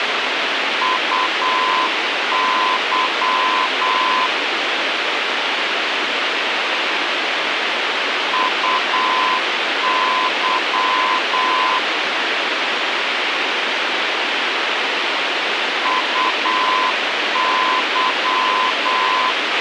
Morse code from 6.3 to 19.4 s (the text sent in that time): UY UY